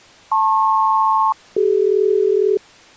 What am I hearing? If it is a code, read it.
Aircraft SELCAL, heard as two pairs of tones. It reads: LP-CD